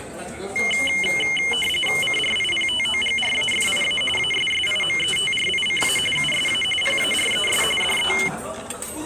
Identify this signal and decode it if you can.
RTTY (45.45 baud, 850 Hz shift), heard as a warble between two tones, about 2550 Hz centre, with the noise of a restaurant. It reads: CRIPTOGRAFIA ASSIMETRICA USA PARES DE